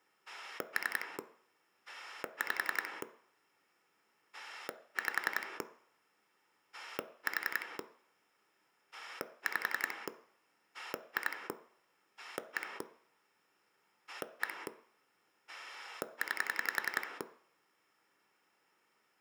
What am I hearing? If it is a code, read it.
Pulse dialling, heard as a rotary dial, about 11 pulses a second, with room echo. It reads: 3 5 5 4 5 2 1 1 9